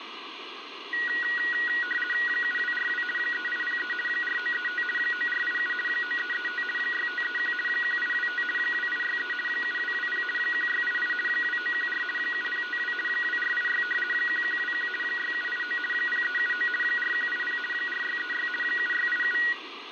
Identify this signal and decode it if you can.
RTTY (50 baud, 450 Hz shift), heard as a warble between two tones, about 1700 Hz centre, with radio static. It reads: 7242 3803 4935 9487 9335 6531 1825 2863 7220 1688 2914 7052 2486 1121 6789 0379 4180 4636 7687